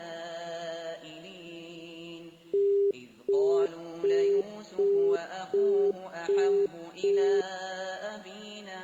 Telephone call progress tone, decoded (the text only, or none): busy tone